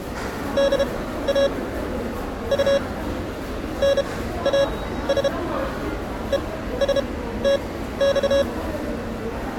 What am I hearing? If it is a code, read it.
Morse code (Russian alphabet), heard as electronic beeps, machine-sent, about 32 wpm, spaced as for 15 wpm, 560 Hz, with the noise of a subway station. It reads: ДА У НАС ЕСТЬ